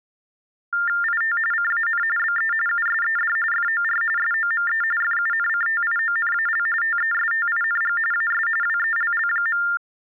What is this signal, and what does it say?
TTY/TDD text telephone tones (45.45 baud Baudot), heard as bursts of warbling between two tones, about 400 Hz shift, 1600 Hz centre. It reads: IT CAN BE USED FOR SOME FUNCTIONAL TESTING AS WELL.